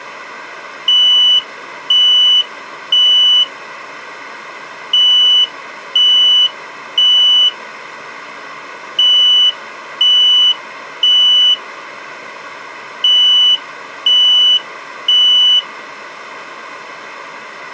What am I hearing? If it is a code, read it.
Alarm pattern, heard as an alarm's beeps, played four times, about 2950 Hz. Temporal three. Smoke or fire, evacuate.